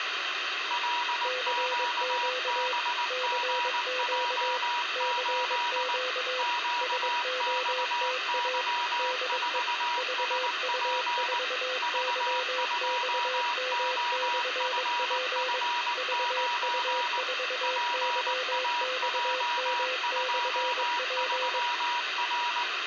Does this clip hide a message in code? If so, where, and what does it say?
Yes: Morse code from 0.6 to 22.7 s, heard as two keyed tones, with radio static and room echo. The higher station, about 19 wpm, 960 Hz: LQBGJ8 QXY4SP V2OFF9 PAJ23R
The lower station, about 22 wpm, 510 Hz: CQ CQ CQ SOTA DE VU4YXM/P VU4YXM/P